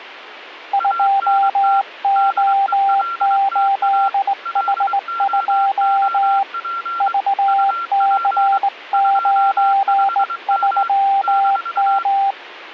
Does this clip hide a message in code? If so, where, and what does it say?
Yes: Morse code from 0.7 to 12.4 s, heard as two keyed tones, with radio static. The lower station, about 19 wpm, 790 Hz: 2O8H2 VC93M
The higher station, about 23 wpm, 1370 Hz: ANT DELTA LOOP UP 25M -